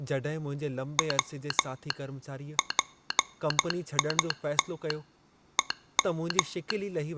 Morse code (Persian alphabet), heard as a telegraph sounder, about 12 wpm, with speech in Sindhi. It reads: و پیت هم